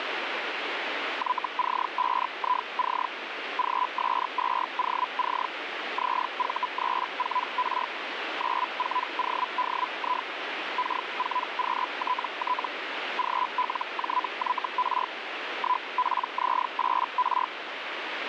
Hellschreiber (Feld-Hell, 122.5 baud), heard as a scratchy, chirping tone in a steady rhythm, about 1000 Hz, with radio static. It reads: YC5IC GS2OC ZV34R 94ODI K4QTT GLJYR 1PZ8R